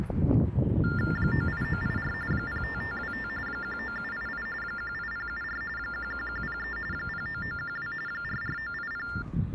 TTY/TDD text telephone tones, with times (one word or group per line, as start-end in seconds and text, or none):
1.2-2.1 98984
2.3-3.3 05525
3.5-4.5 19788
4.6-5.6 18074
5.8-6.8 11103
6.9-7.9 09912
8.1-9.1 44980